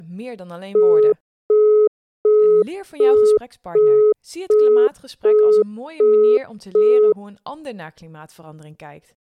Telephone call progress tone (as in the UK, Australia and similar networks), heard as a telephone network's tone, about 420 Hz, 0.375 s on and 0.375 s off, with speech in Dutch. Busy tone.